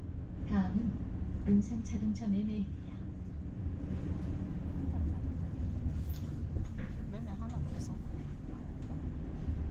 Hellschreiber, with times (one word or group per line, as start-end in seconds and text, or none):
none